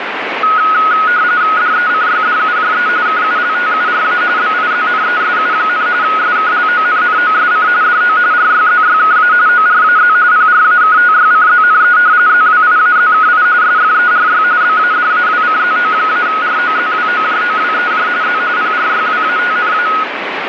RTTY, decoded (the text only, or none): DECYDUJE KULTURA BIZNESU, SKLONNOSC DO RYZYKA ORAZ PRAKTYCZNE ZWIAZKI SFERY BADAWCZO-ROZWOJOWEJ Z PRYWATNA